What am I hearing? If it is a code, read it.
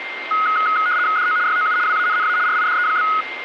RTTY (75 baud, 170 Hz shift), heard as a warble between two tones, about 1360 Hz centre, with radio static and a steady whistle near 2100 Hz. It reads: DO YOU WANNA RIDE?